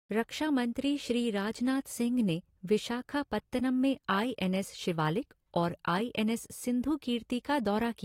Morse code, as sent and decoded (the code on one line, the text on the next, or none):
none